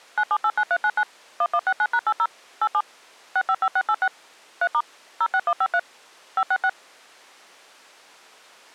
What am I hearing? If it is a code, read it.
DTMF, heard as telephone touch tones, dialled by machine, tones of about 60 ms. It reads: 9789399 1169#80 87 655686 3* 06153 566